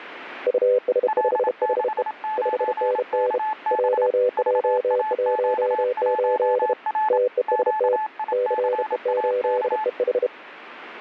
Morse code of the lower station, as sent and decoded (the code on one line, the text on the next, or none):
..- ... ..... .... . / ..... -. -. / .--- .--- .---- ---.. / - . ... - / -.-. . ---.. . ....
US5HE 5NN JJ18 TEST CE8EH